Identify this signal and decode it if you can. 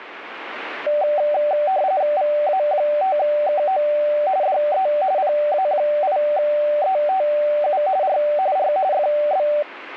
RTTY (45.45 baud, 170 Hz shift), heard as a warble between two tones, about 680 Hz centre. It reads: VA5KO DE PA8ETU R R FB